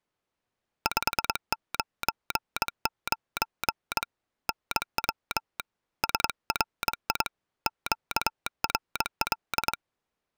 Morse code, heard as a telegraph sounder, hand-sent with a straight key, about 22 wpm. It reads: 599 NW SRI QRL